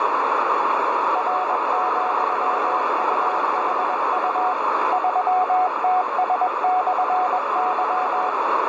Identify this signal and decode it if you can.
Morse code, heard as a keyed tone, machine-sent, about 21 wpm, 740 Hz, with heavy radio static and a narrow filter. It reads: R,UHU 3TS/Y